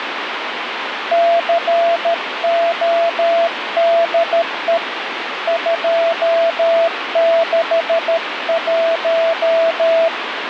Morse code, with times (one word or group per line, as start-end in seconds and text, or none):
1.1-4.8 CODE
5.5-10.1 261